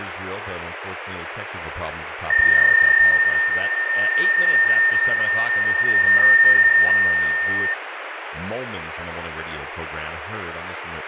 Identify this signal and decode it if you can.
PSK31 (31.25 baud), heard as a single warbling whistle, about 1800 Hz, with radio static, fading and speech in English.